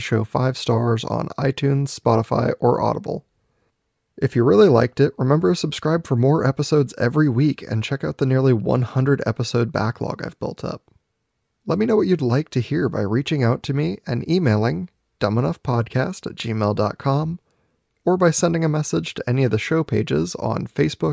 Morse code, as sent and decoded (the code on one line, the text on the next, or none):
none